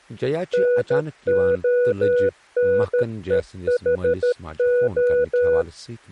Morse code, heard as a keyed tone, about 13 wpm, 490 Hz, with speech in Kashmiri. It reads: NONEHO